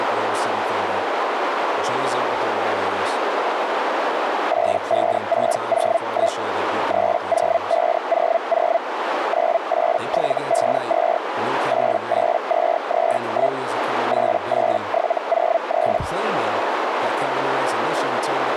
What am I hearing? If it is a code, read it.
Hellschreiber (Feld-Hell, 122.5 baud), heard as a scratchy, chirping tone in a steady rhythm, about 670 Hz, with radio static, a narrow filter and speech in English. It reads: 85601 30500 98752 88231 88703